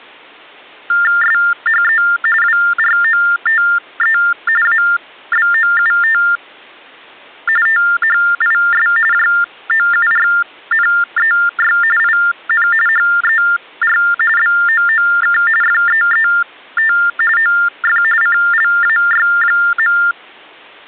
TTY/TDD text telephone tones (45.45 baud Baudot), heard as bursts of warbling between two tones, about 400 Hz shift, 1600 Hz centre. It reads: SHE WROTE ABOUT THIS JOURNEY IN HER BOOK FEET OF CLAY.